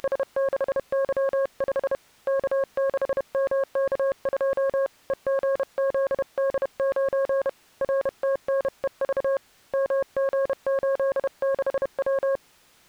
Morse code, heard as a keyed tone, hand-sent with a paddle, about 31 wpm, 540 Hz. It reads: … K6MK2 EGZD9 RTNEV MG86W